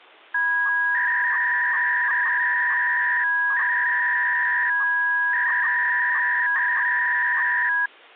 300-baud modem data (V.21 tones), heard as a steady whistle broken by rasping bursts, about 300 baud, 200 Hz shift.